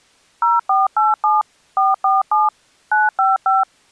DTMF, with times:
0.4-1.4 0487
1.8-2.5 447
2.9-3.6 955

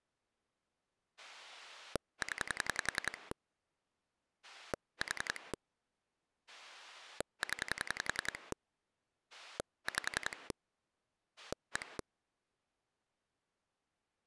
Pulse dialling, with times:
1.2-3.3 0
4.4-5.5 4
6.5-8.5 0
9.3-10.5 5
11.4-12.0 1

